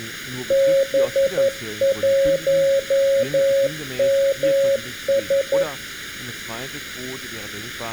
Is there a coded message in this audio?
Yes: Morse code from 0.4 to 5.7 s, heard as a keyed tone, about 11 wpm, 550 Hz, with room echo and speech in German. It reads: B1MS